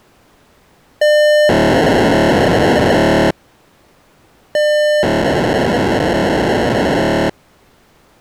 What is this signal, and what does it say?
POCSAG pager data (1200 baud), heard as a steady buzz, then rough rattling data.